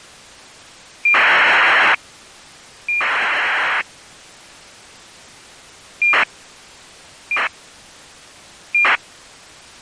ACARS aircraft data, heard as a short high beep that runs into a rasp, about 2400 baud.